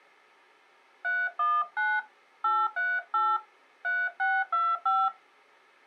DTMF, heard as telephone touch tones, dialled by hand, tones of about 230 ms. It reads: 319 838 3625